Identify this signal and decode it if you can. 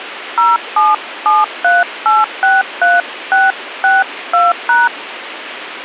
DTMF, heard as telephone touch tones, dialled by hand, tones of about 180 ms, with radio hiss. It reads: 0773863662#